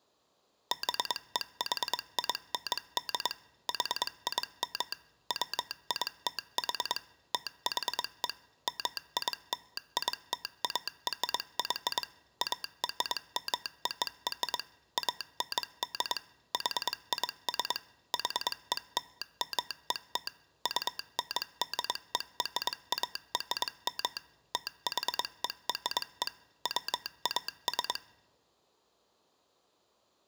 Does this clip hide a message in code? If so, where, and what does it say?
Yes: Morse code (American railroad code) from 0.7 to 28.0 s, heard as a telegraph sounder, machine-sent. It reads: BEHIND HIM WITH THE MILITARY ARMOR AND HIS HELMET UNDERARM THERE WAS